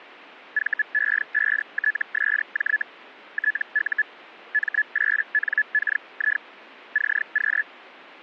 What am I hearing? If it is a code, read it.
Hellschreiber (Feld-Hell, 122.5 baud), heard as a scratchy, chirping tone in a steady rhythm, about 1700 Hz. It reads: VE5TSJ TU M8NKI CQ